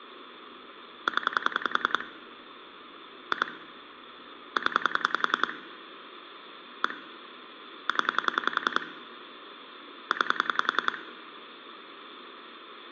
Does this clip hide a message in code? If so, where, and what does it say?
Yes: pulse dialling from 1.1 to 11.0 s, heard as clicks on a phone line, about 10 pulses a second, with phone line noise and room echo. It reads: 0 2 0 1 0 9